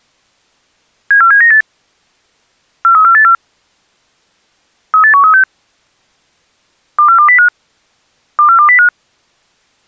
Five-tone selective call (CCIR), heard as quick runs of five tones, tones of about 100 ms. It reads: 74798 43484 38136 24205 24205